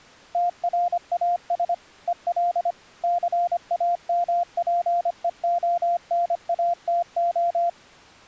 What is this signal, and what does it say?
Morse code, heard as a keyed tone, machine-sent, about 25 wpm, 700 Hz. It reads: TRAS EL CAMPEONATO